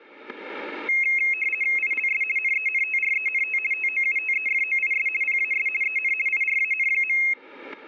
RTTY (50 baud, 450 Hz shift), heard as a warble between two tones, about 2350 Hz centre, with static crashes. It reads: ILS NENTRENT TOUTEFOIS PAS EN IRAN.